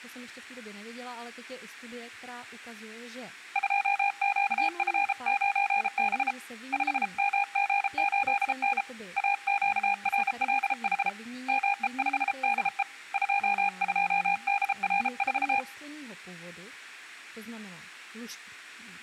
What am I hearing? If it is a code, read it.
Morse code, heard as a keyed tone, hand-sent with a paddle, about 33 wpm, 810 Hz, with speech in Czech. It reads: 2QF9B 5MG8N AQRLH ME5DE 22DR4